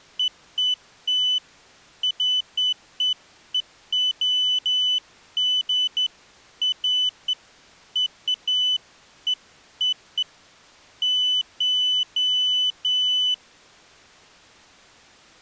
Beeps of irregular length. There is no code.